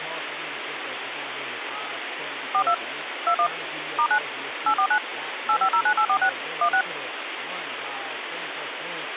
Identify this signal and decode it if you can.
DTMF, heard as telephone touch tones, dialled by machine, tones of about 80 ms, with phone line noise and speech in English. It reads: 42 21 *9 849 8509846 16